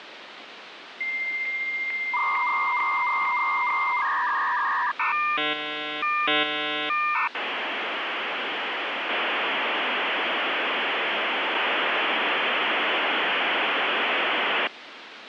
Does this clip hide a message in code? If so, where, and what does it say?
Yes: dial-up modem handshake (V.34 or later) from 1.0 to 14.7 s, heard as a whistle, warbles, then hiss, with phone line noise.